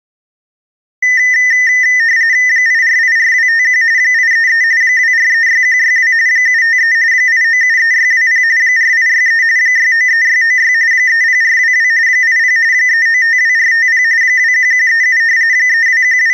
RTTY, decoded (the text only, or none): 8484251 833 2436162 753 8973620 4863 693696 30422 80 3952450 21137 …